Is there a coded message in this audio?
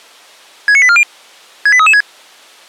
Yes: five-tone selective call (ZVEI) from 0.7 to 2.0 s, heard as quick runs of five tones, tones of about 70 ms. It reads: 69840 68336